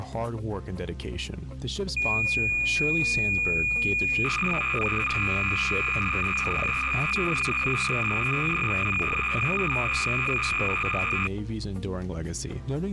Cassette data (Kansas City type), 300 baud, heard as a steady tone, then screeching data.